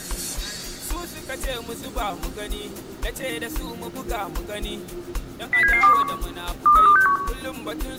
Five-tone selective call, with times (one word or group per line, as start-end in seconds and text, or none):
5.5-6.0 07721
6.7-7.2 23261